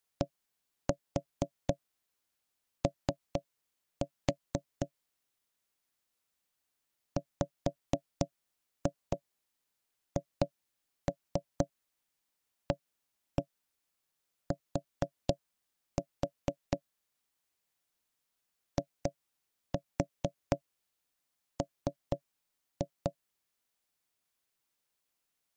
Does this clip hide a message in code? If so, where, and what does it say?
Yes: tap code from 0.2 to 23.2 s, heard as knocks on wood, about 4 knocks a second. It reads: DO WHAT IM